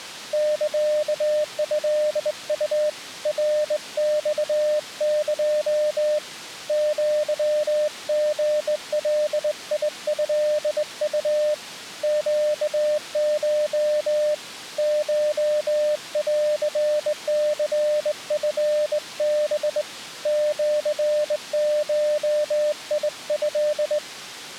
Morse code (Japanese Wabun code), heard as a keyed tone, hand-sent with a straight key, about 20 wpm, 600 Hz. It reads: サトウ ナマエ アリガトウ ネコ コンニチハ シゴト